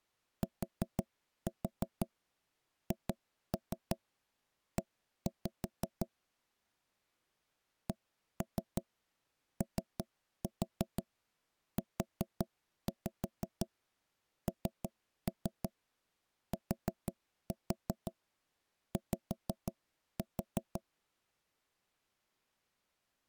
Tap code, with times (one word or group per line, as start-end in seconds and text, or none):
0.4-6.1 THE
7.9-20.8 COUNTY